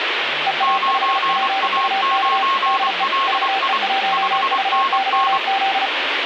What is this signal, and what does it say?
Morse code, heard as two keyed tones, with radio static and speech in Marathi. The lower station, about 35 wpm, 780 Hz: EA5PUK DE VE1VYZ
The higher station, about 24 wpm, 1080 Hz: 9A9LI 5NN